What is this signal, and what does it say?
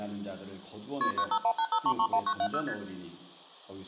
Multi-frequency trunk signalling (R1, as on North American trunks), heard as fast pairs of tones, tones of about 70 ms. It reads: KP 95185331970 ST